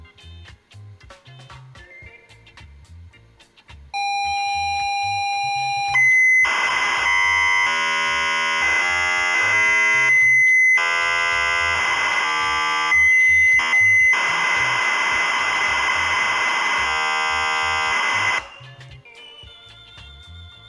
ZX Spectrum tape loading, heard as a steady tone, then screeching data, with room echo.